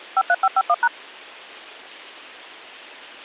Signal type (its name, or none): DTMF